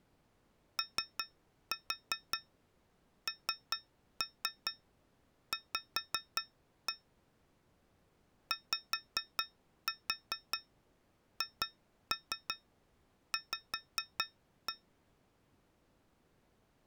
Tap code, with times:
0.8-6.9 ONV
8.5-14.7 YHV

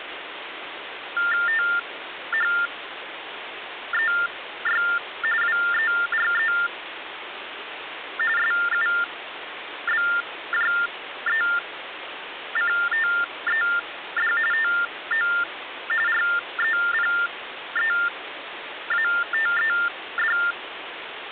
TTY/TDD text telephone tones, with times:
1.5-4.8 THEY
5.4-6.5 WERE
8.4-14.3 SUBJECTED
14.5-15.3 TO
16.1-20.4 REPEATED

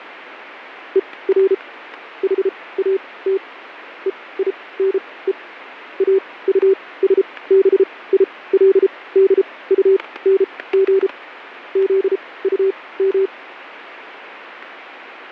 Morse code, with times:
1.0-1.5 ER
2.2-3.4 HAT
4.1-5.3 EINE
6.0-11.1 AUSBILDUNG
11.8-13.3 ZUM

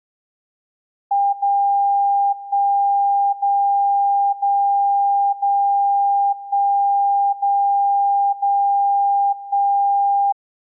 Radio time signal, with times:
1.3-2.3 0
2.3-3.3 1
3.3-4.3 0
4.3-5.3 0
5.3-6.3 0
6.3-7.3 1
7.3-8.3 0
8.3-9.3 0
9.3-10.3 1

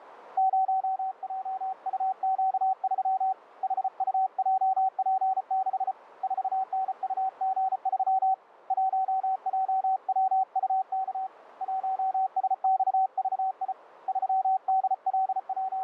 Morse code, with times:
0.4-3.3 0JUQ3
3.6-5.9 HUJP6
6.2-8.3 4NUG3
8.7-11.3 1JWUK
11.6-13.7 1SXVI
14.1-15.8 …

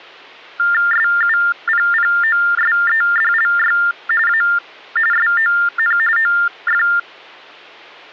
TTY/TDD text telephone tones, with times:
0.9-3.8 SUPPOSEDLY
4.3-4.4 A
5.1-6.0 SON
6.2-6.8 OF

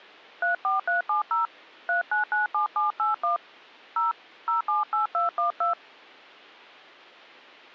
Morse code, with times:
none

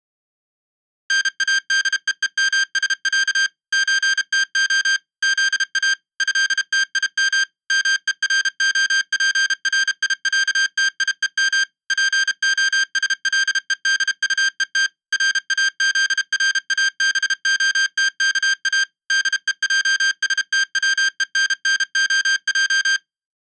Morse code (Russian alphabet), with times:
1.1-3.5 НАДЕЕМСЯ
3.7-5.0 ЧТО
5.2-5.9 ЗА
6.2-7.4 ЭТИМ
7.7-11.6 МЕРОПРИЯТИЕМ
11.9-14.9 ПОСЛЕДУЕТ
15.1-18.8 РАЗРАБОТКА
19.1-23.0 ДЕЙСТВЕННОЙ

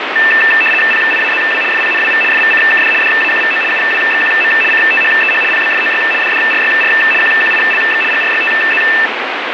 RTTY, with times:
0.9-1.6 PIAZW
1.7-2.2 FPNWV
2.3-2.9 FVCKD
3.0-3.6 DAQVO
3.7-4.5 UWXQM
4.7-5.4 CTHEH
5.5-6.0 PBFOY
6.2-6.9 DDRYR
7.2-8.0 QQILX
8.1-8.8 GRYTZ

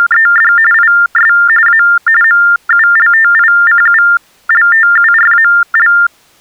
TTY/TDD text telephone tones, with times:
0.0-0.5 …
0.7-1.3 IS
1.7-1.8 A
2.2-5.9 MULTICULTURAL

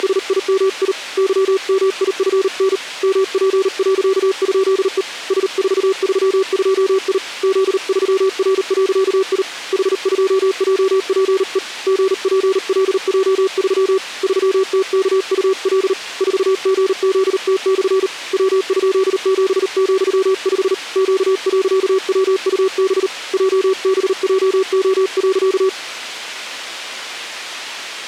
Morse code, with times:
0.0-0.9 …
1.2-2.8 YMIFN
3.0-5.0 MP.?E
5.3-7.2 S432I
7.4-9.4 Z3R.I
9.7-11.6 H2JPE
11.9-14.0 GPLJ3
14.2-15.9 3TKUL
16.2-18.1 4GZT/
18.3-20.7 W?7,5
21.0-23.1 Q.WUB
23.3-25.7 JBJO.

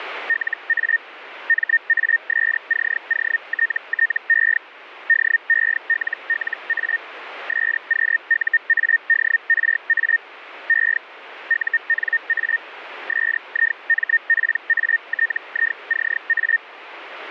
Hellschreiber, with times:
0.3-1.0 LA
1.5-4.6 MASCOTTE
5.1-7.0 DELLA
7.5-10.2 SQUADRA
10.7-11.0 E
11.5-12.6 UNA
13.1-16.6 SIMPATICA

